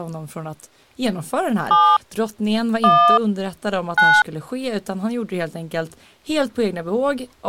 DTMF, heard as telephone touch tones, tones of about 280 ms, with speech in Swedish. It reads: 7 1 9